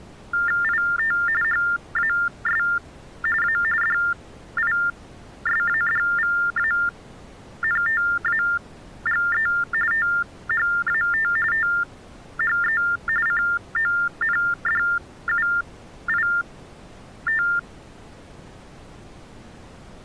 TTY/TDD text telephone tones (45.45 baud Baudot), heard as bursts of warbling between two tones, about 400 Hz shift, 1600 Hz centre. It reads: IT HAS A DISADVANTAGE THAT THE CONDUIT